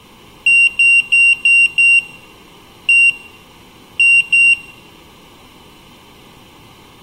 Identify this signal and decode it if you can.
Beep code, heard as a piezo beeper, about 2750 Hz, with room echo. 5-1-2.